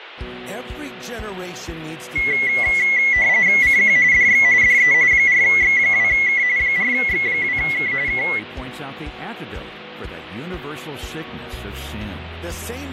RTTY (45.45 baud, 170 Hz shift), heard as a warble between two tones, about 2050 Hz centre, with radio static and fading. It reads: CQ DX DE 4X2K 4X2K K